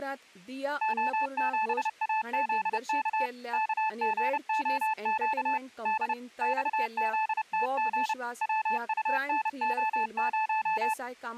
Morse code, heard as a keyed tone, machine-sent, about 30 wpm, 870 Hz, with speech in Goan Konkani. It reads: O7AZK KGOQ D XZTG WUNO0